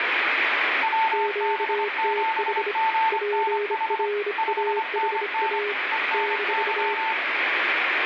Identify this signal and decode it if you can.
Morse code, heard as two keyed tones, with heavy radio static. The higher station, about 25 wpm, 890 Hz: WB7GNH 5NN ENY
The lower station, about 26 wpm, 410 Hz: QTH PRAHA -